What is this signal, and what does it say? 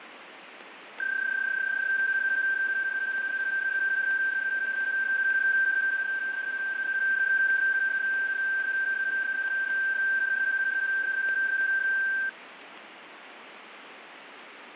PSK31 (31.25 baud), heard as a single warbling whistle, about 1550 Hz, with radio static.